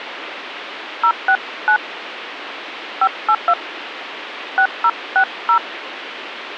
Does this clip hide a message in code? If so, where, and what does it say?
Yes: DTMF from 1.0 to 5.6 s, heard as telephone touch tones, dialled by hand, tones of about 70 ms, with radio hiss. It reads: 069 582 6060